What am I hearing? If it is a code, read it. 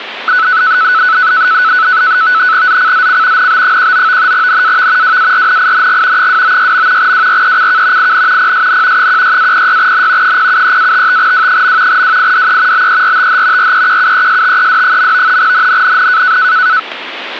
NAVTEX (SITOR-B), 100 baud, 170 Hz shift, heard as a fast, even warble, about 1400 Hz centre. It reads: ZCZC NB19 NAV WARNING 296. WRECK IN PSN 16-06N 073-55W. WIDE BERTH REQUESTED. NNNN